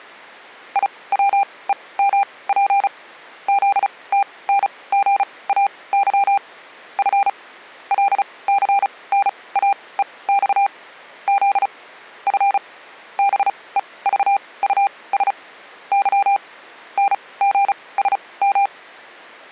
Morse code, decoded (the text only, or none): IWEMP ZTNGAY F LCNAEX Z F BEVUS Y NGSM